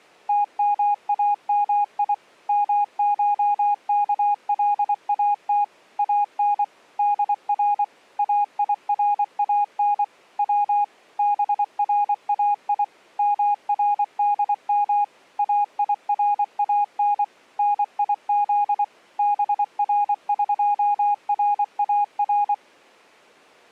Morse code (Persian alphabet), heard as a keyed tone, machine-sent, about 24 wpm, 820 Hz. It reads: تمامی مشکلات ان در ایران و برای مردم ایران نیز برقرار